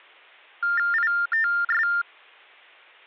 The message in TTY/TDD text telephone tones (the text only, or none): ITS